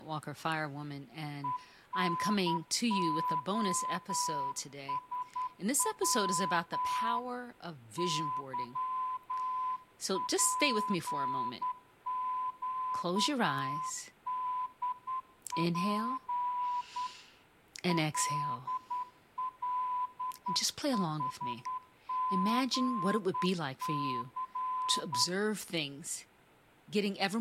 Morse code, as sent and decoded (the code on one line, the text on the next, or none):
. -. --- ... .-- / -.-- .--. --.- -.. .--. / .-.. .-.. .... --. -.-.
ENOSW YPQDP LLHGC